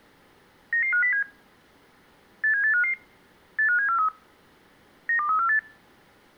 Five-tone selective call (CCIR), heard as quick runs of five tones, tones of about 100 ms. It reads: 99507 87855 85743 92348